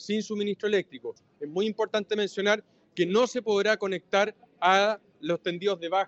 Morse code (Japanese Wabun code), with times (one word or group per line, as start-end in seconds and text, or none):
none